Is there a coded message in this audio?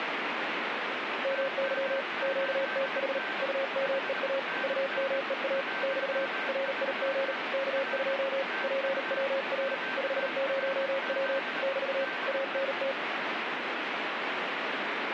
Yes: Morse code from 1.2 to 13.0 s, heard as a keyed tone, hand-sent with a paddle, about 38 wpm, 540 Hz, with radio static and a weaker station near 1550 Hz. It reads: MY QTH UMEA UMEA <BT> RIG K2 PWR 50W <BT> ANT